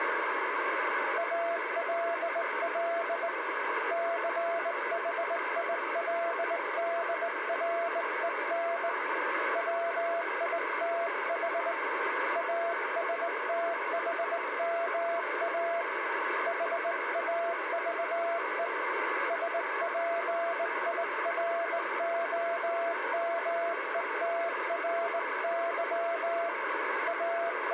Morse code, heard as a keyed tone, hand-sent with a straight key, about 19 wpm, 680 Hz, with radio static. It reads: ALL CHILDREN WITH ASTHMA HAVE SPIROMETRY …